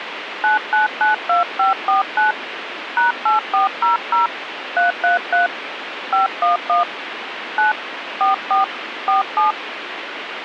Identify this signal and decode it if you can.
DTMF, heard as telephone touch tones, dialled by hand, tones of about 140 ms, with radio hiss. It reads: 9992549 #8400 333 511 9 44 47